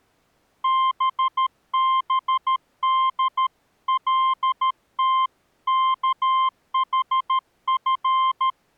Morse code (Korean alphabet), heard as a keyed tone, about 13 wpm, 1050 Hz. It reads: 뜨거운